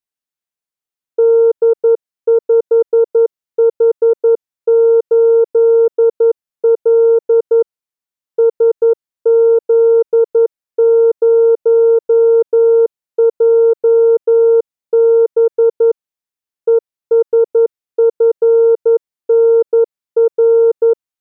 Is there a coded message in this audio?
Yes: Morse code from 1.1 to 21.0 s, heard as a keyed tone, machine-sent, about 11 wpm, 460 Hz. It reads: D5H8L SZ0JB ESFNR